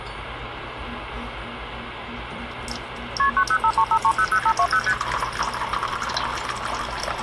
Multi-frequency trunk signalling (R1, as on North American trunks), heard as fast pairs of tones, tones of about 70 ms, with phone line noise and kitchen noise. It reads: KP 90535300520 ST